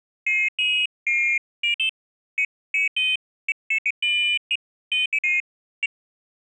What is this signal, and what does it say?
Pairs of high tones at irregular times. There is no code.